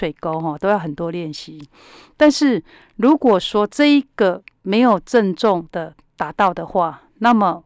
Speech in Chinese. There is no code.